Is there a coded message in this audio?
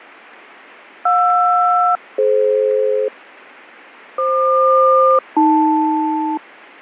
Yes: aircraft SELCAL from 1.1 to 6.4 s, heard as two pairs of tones, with fading. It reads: JR-DF FQ-AL